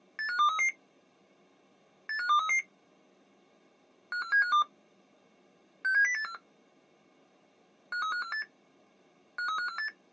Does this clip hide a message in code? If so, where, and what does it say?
Yes: five-tone selective call (CCIR) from 0.2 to 9.9 s, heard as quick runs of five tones, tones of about 100 ms. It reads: 85233 85233 54752 67084 53548 53548